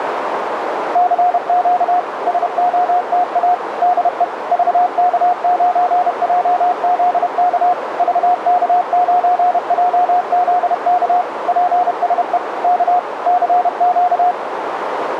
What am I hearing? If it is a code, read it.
Morse code, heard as a keyed tone, machine-sent, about 31 wpm, 720 Hz, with radio static and a narrow filter. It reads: CQ SOTA DE VK9JZK VK9JZK PSE K CQ